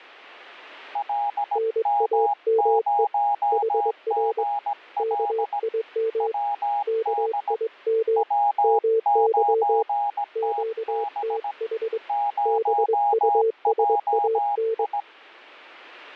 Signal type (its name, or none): Morse code